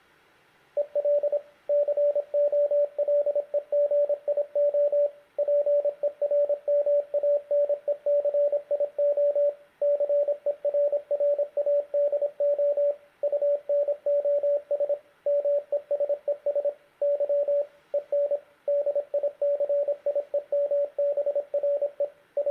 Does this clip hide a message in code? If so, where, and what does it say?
Yes: Morse code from 0.7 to 22.5 s, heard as a keyed tone, machine-sent, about 26 wpm, 580 Hz, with room echo. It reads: EL COLEGIO PERMANECIO CERRADO UNOS MESES Y EN DICIEMBRE …